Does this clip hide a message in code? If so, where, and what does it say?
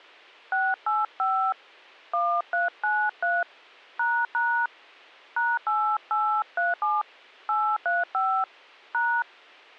Yes: DTMF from 0.5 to 9.2 s, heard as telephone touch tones, dialled by hand, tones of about 240 ms. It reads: 685 1393 ## #8837 835 #